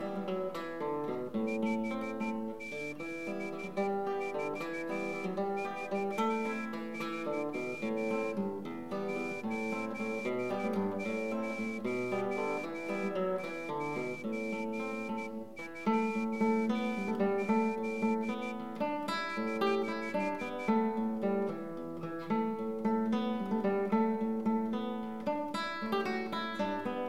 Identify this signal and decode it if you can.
Morse code, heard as a whistle, hand-sent with a straight key, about 13 wpm. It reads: 57443 8092Z <HH>